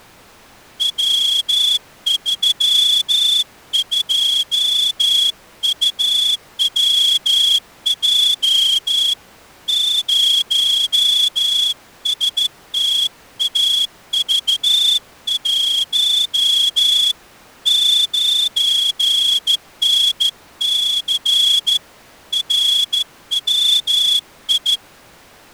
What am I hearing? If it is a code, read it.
Morse code, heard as a whistle, hand-sent with a straight key, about 14 wpm. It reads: W32UWJ 0STAV1 9NC RWI